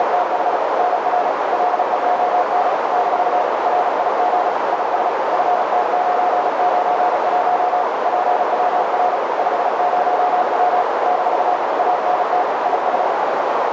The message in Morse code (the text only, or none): … NR LEON - RIG IS FT991 PWR 50W - ANT IS